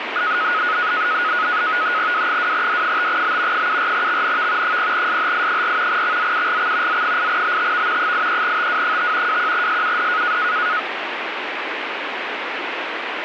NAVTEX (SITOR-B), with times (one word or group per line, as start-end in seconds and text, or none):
2.1-3.7 W2D5B
3.5-4.8 74XNV
4.6-6.0 0SHI4
5.9-7.0 XZUGX
6.9-8.1 Z8BTV
8.0-9.4 83TW5
9.3-10.4 21SUD